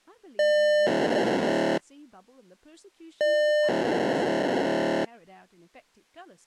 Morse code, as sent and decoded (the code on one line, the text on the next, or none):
none